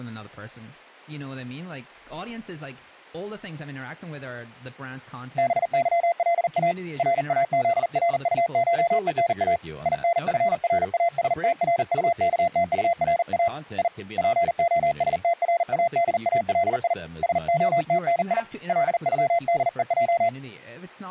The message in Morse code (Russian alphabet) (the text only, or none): БЫЛА РАЗРУШЕНА ИНФРАСТРУКТУРА И ПОСТРАДАЛИ СОТНИ ЛЮДЕЙ